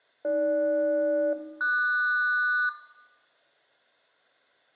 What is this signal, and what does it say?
Aircraft SELCAL, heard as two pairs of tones, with room echo. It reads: AG-QS